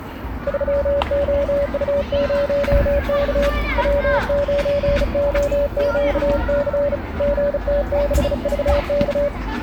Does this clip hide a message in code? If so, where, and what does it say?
Yes: Morse code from 0.4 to 9.3 s, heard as a keyed tone, hand-sent with a bug key, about 35 wpm, 570 Hz, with the noise of a park. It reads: 3OU0K W9OQC GT6VK